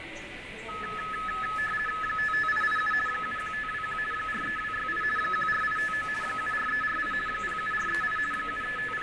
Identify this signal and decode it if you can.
RTTY (50 baud, 450 Hz shift), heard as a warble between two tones, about 1500 Hz centre, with radio static, fading, room echo and the noise of a subway station. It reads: 55887 71521 43268 14859 74348 07438 …